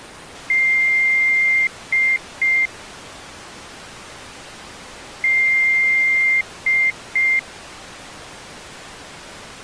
Beep code, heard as beeps, played twice, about 2100 Hz. 1 long, 2 short. In Award, IBM and AMI BIOS tables: video adapter failure.